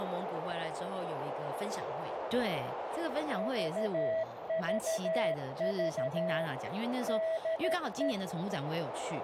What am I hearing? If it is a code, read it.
Morse code, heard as a keyed tone, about 13 wpm, 650 Hz, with heavy radio static, a narrow filter and speech in Chinese. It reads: VVV DE